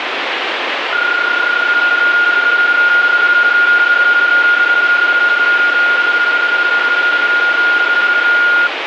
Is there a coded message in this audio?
Yes: PSK31 (31.25 baud) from 0.9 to 8.7 s, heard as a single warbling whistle, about 1420 Hz, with radio static.